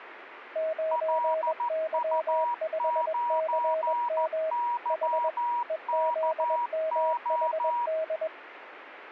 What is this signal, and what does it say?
Morse code, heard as two keyed tones, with radio static. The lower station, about 21 wpm, 640 Hz: 9Y5CM H EZMHD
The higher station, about 14 wpm, 960 Hz: LU9YKO